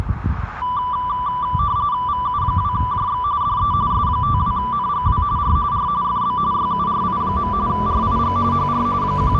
RTTY (45.45 baud, 170 Hz shift), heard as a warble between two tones, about 1080 Hz centre, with radio static, a narrow filter and street noise. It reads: VU2JX DE S52NGW R R FB YURI. RIG HR …